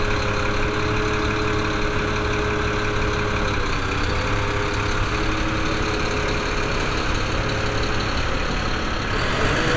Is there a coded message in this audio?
No, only street noise.